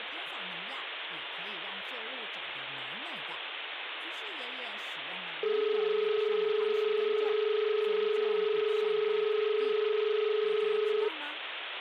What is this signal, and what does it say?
Telephone call progress tone (as in Australia), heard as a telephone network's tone, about 430 Hz, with phone line noise and speech in Chinese. Dial tone.